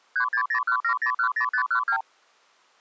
Multi-frequency trunk signalling (R2, with the far end's replies), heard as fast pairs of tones, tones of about 90 ms. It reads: 36017010512